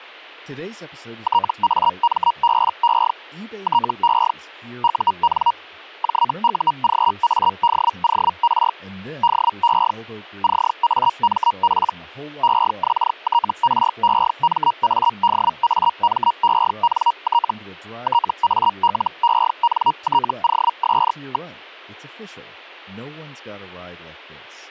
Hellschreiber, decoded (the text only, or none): TAMBE TE UN JUGADOR DE CAMP EXTREMADAMENT TALENTOS.